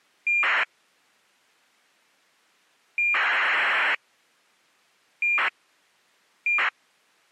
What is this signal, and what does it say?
ACARS aircraft data, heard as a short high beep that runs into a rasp, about 2400 baud.